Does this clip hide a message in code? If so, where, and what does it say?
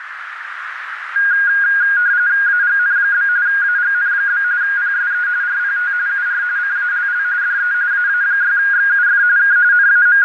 Yes: RTTY (45.45 baud, 170 Hz shift) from 1.2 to 10.2 s, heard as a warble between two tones, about 1550 Hz centre, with radio static and a narrow filter. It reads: AGN? AGN? PSE RPT UR CALL DE AA6XUF K …